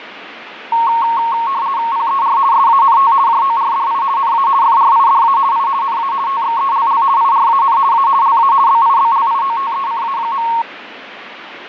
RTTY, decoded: PER SANT JORDI NA FRIDA I NA TXELL IRAN A LA BIBLIOTECA.

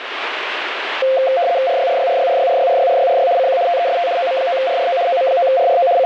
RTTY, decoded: RYRYRYRYRYRYRYRY CQ TEST OM9RRO OM9RRO …

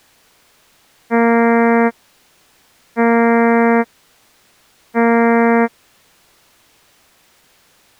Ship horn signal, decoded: 3 short

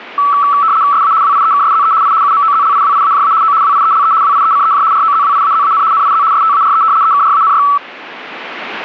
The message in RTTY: SA WIEKSZE I UMOZLIWIAJA O WIELE WIECEJ ROZWIAZAN NIZ STARE EKRANY

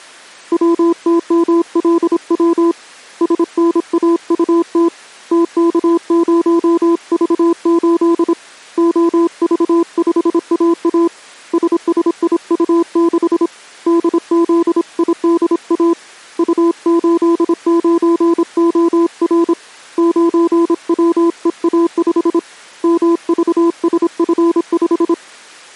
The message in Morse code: WTMLW SNAUT TK0V8 OV5AA SSIU6 DZIDA U89OR 9WEA5 MVSF5

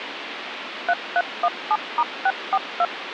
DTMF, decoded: 3317*642

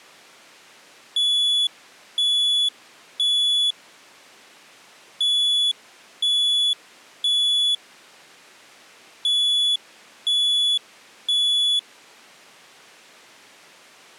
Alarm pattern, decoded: temporal three

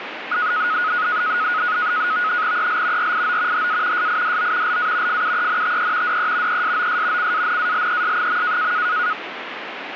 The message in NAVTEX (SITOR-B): EL RIO HA SIDO LA FUENTE DE ESOS CANALES.

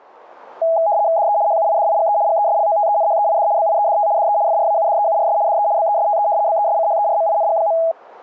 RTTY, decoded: DE HUIDIGE GESLOTENHEID BIEDT DE FRAUDEURS DE BESTE BESCHERMING.

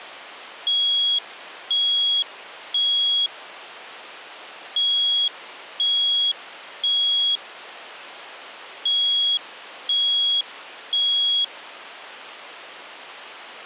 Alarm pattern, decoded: temporal three

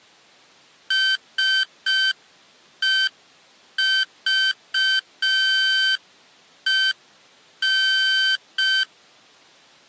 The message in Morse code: SEVEN

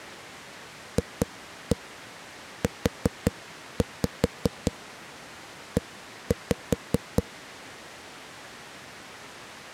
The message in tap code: FUE

